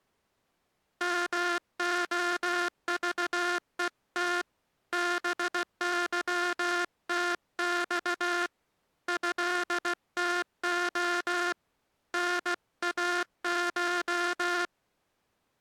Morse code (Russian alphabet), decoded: МОЖЕТ БЫТЬ ЭТО НАШ

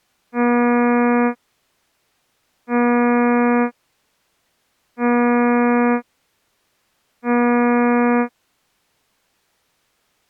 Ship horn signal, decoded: 4 short

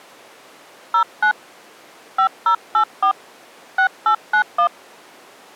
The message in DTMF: 09 5084 6891

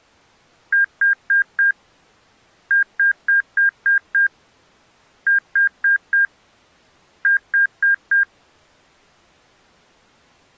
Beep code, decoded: 4-6-4-4

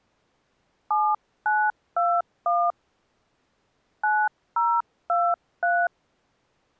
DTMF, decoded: 7921 9023

